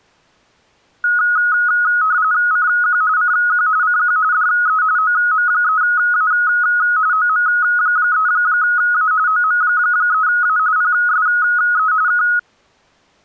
RTTY (45.45 baud, 170 Hz shift), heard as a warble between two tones, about 1360 Hz centre. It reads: CQ CQ CQ DE OM3A OM3A OM3A PSE K